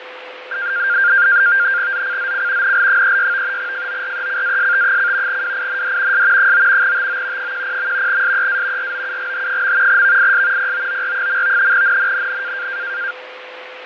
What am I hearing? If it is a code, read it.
NAVTEX (SITOR-B), 100 baud, 170 Hz shift, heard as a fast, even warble, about 1500 Hz centre, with radio static, fading and a steady whistle near 510 Hz. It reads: ZCZC NL36 FORECAST: WIND S 9 TO 10. SEA ROUGH. VIS POOR. NNNN